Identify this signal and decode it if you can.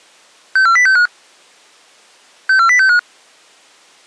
Five-tone selective call (CCIR), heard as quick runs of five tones, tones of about 100 ms. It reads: 64065 64065